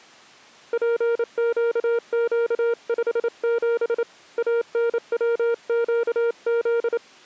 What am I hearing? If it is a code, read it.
Morse code, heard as a keyed tone, hand-sent with a paddle, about 28 wpm, 470 Hz. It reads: PQQ57 ANWQZ